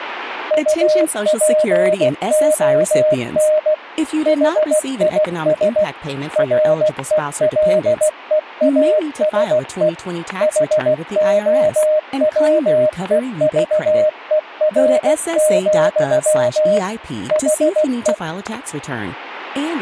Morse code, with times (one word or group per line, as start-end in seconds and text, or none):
0.5-3.7 UPON
4.3-5.8 HIS
6.4-9.9 RELEASE
10.4-16.8 HOWEVER,
17.3-18.1 HE